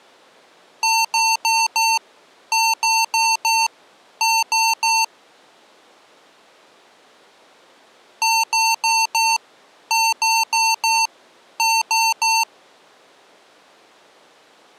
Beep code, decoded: 4-4-3

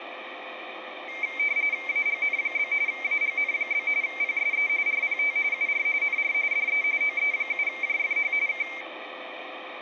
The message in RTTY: AGN? AGN? PSE RPT UR NR DE OE7JFH K

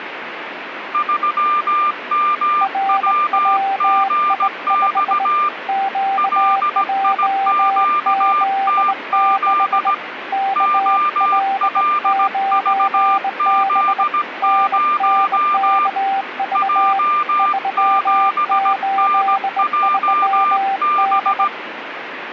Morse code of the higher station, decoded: 3MWGX LIQTZ OLVZ0 J7NJB

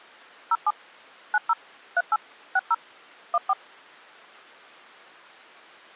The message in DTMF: 07 90 38 60 14

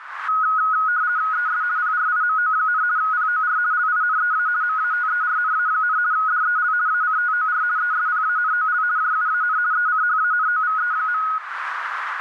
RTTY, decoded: ES PRIMO, POR LINEA MATERNA, DEL ACTOR ESPANOL JUAN ECHANOVE.

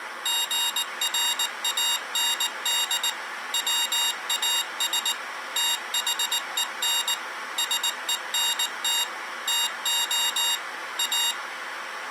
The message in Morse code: GRAND WAS THEN SENT TO A

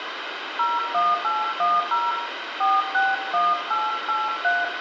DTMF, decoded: 01810 461883

